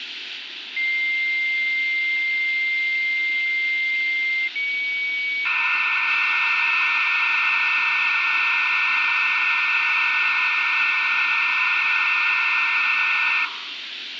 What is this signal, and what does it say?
Dial-up modem handshake (low-speed, two carriers), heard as two whistles, then hiss, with phone line noise.